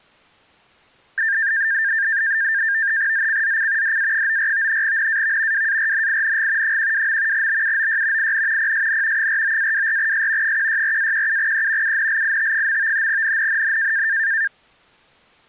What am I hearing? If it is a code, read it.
NAVTEX (SITOR-B), 100 baud, 170 Hz shift, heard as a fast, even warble, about 1700 Hz centre. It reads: ZCZC DA94 NAV WARNING 12. BUOY IN PSN 49-24S 164-17E UNLIT. NNNN